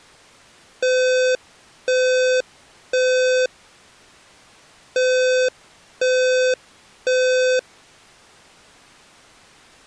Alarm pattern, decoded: temporal three

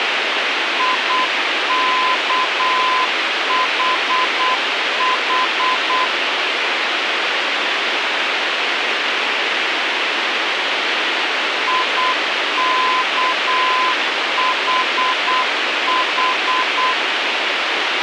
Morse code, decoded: IKHH IKHH

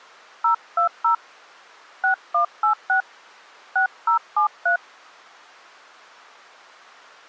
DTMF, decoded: 020 6186 6073

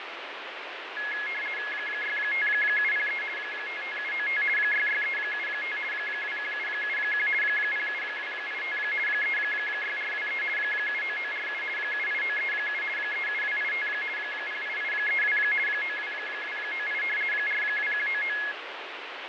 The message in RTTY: 65703 55795 66375 21771 07285 36423 79947 78937 37285 08832 92298 42199

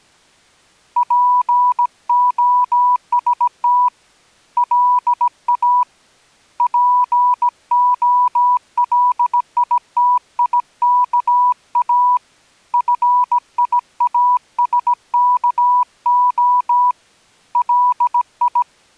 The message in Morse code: POST LA POLITIKA FIASKO LI

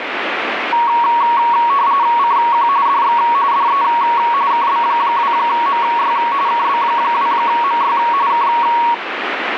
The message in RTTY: CQ DX DE KB2MY KB2MY K

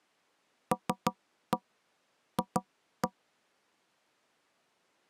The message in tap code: LF

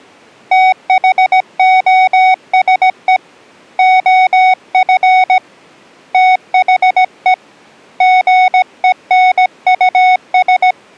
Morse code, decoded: THOSE OF THE GENUS

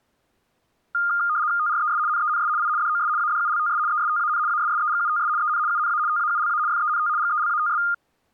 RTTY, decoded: TRES NENS I DOS ADULTS ESTAN ASSEGUTS EN UNA TAULA FENT GELATS

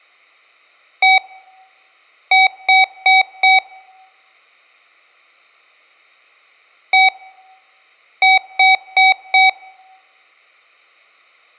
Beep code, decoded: 1-4

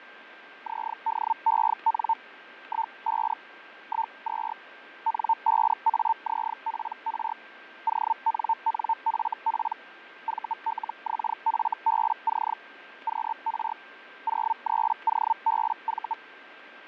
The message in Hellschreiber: ZDEN 15 12 N5AZPR ONNFP VLXFBC QR 03OBV

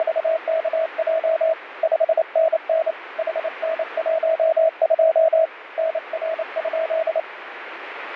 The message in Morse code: … 5NN HN12 NR?

